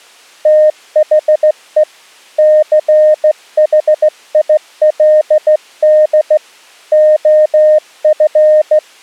Morse code, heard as a keyed tone, hand-sent with a straight key, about 15 wpm, 610 Hz. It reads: THE CHILD OF